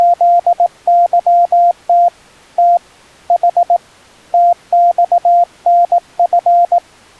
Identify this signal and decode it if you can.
Morse code, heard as a keyed tone, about 18 wpm, 700 Hz. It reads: … T H TXNF